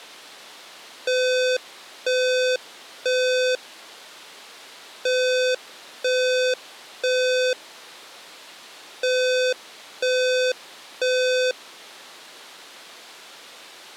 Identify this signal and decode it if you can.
Alarm pattern, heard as an alarm's beeps, played three times, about 510 Hz. Temporal three. Smoke or fire, evacuate.